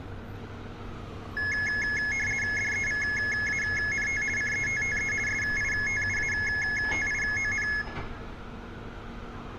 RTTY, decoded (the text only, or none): DEVANT CETTE SITUATION